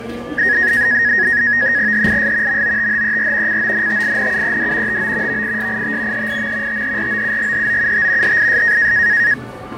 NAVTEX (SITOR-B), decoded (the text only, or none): HIS MOTHER CONTINUED TO VISIT HIM THROUGHOUT HIS